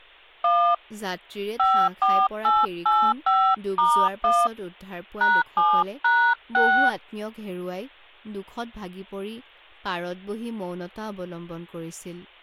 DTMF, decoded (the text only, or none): 1 54885*1 #7#6